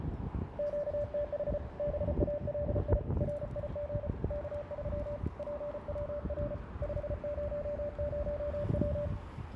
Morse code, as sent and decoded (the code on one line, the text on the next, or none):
--.- - .... / -... .- .-.. .. / .-. .. --. / -.- ...-- / .--. .-- .-. / ..... ----- ----- .--
QTH BALI RIG K3 PWR 500W